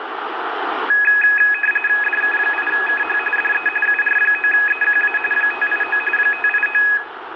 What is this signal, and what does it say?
RTTY (45.45 baud, 850 Hz shift), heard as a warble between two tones, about 2100 Hz centre, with radio static and room echo. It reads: DK8KH DE UR9EQA 589 589